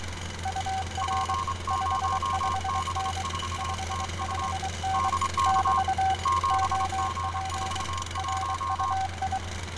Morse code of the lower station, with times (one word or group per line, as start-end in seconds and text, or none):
0.5-1.3 UR
1.7-3.2 55N
3.6-5.1 55N
5.5-6.1 <BT>
6.5-7.8 OP
8.2-9.4 RUI